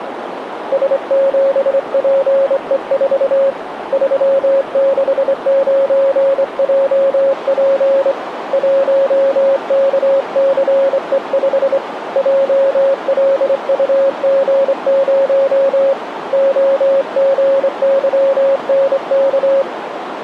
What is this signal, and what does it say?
Morse code, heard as a keyed tone, hand-sent with a straight key, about 25 wpm, 550 Hz, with radio static and a narrow filter. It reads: S7PE4 369JP 1KCE5 JLUG0 OGYNK